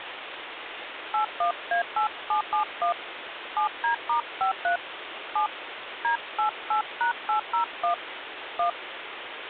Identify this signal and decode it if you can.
DTMF, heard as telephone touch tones, dialled by hand, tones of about 110 ms, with phone line noise. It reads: 81A8771 7D*53 7 D88#801 1